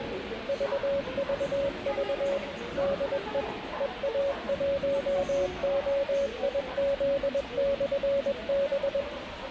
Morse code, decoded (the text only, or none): VVV DE EA1OIZ/B